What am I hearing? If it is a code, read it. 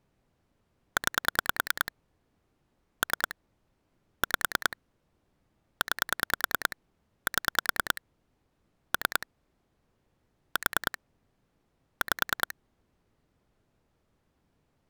Pulse dialling, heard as clicks on a phone line, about 10 pulses a second. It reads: 9 3 5 9 7 3 4 5